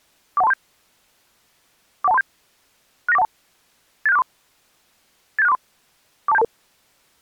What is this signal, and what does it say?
Five-tone selective call (EIA), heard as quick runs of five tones, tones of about 30 ms. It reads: 41237 41237 69412 87643 87643 42722